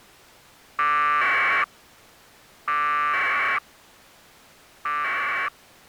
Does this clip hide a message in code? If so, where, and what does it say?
Yes: packet radio (AX.25, as in APRS), 1200 baud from 0.8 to 5.5 s, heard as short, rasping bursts.